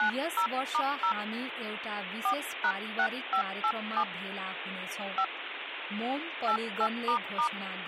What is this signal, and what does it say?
DTMF, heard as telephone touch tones, dialled by hand, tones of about 80 ms, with phone line noise and speech in Nepali. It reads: 90*0 4#6587 5 88**